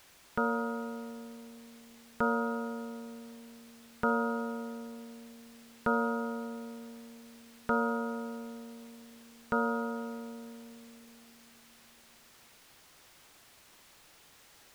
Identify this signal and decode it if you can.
Clock strike, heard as a bell. 6. Six o'clock.